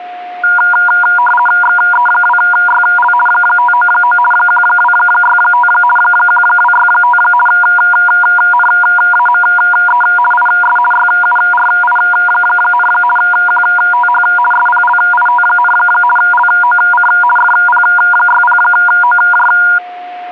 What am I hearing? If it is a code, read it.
RTTY (50 baud, 450 Hz shift), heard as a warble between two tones, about 1200 Hz centre, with a steady whistle near 720 Hz. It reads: XE2YL 599 1265 1265 NAME IS YURI, QTH SPLIT, LOC FP60OJ